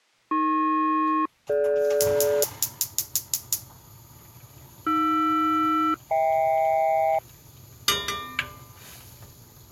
Aircraft SELCAL, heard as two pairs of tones, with kitchen noise. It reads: AP-DG AR-HK